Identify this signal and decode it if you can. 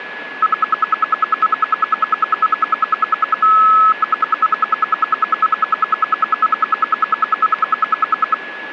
Radio time signal (RWM, Moscow), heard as ten pulses a second, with a steady whistle near 1700 Hz.